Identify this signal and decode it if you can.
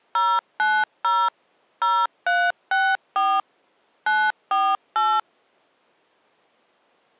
DTMF, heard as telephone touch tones, dialled by machine, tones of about 240 ms. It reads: 090 0364 948